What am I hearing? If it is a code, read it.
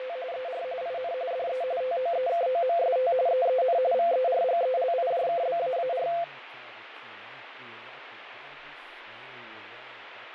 RTTY (45.45 baud, 170 Hz shift), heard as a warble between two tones, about 600 Hz centre, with radio static, fading and speech in Portuguese. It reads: … ER IN DE TOEKOMST EEN VERGELIJKBAAR